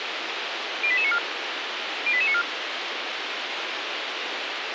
Five-tone selective call (ZVEI), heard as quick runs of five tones, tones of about 70 ms, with radio hiss. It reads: 08894 08894